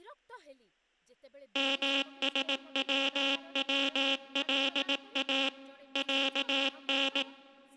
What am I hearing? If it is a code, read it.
Morse code (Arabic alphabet), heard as a buzzer, machine-sent, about 18 wpm, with speech in Odia. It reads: مسوولا عن